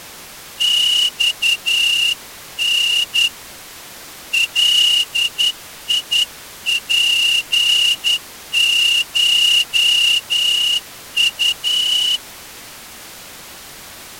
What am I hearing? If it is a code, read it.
Morse code (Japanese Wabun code), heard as a whistle, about 10 wpm. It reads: マタ ガツコウ